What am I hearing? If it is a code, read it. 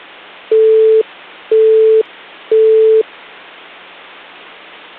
Telephone call progress tone (single-tone plan, as in Europe, Japan and elsewhere), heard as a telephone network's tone, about 440 Hz, 0.5 s on and 0.5 s off. Busy tone.